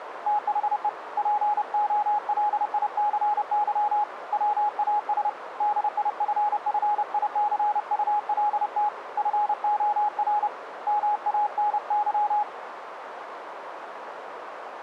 Morse code, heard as a keyed tone, hand-sent with a paddle, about 30 wpm, 840 Hz, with radio static and a narrow filter. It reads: THE POLICY WAS DIFFICULT FOR MANY